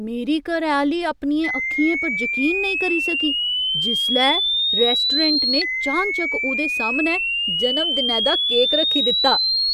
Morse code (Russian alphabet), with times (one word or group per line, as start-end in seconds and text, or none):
none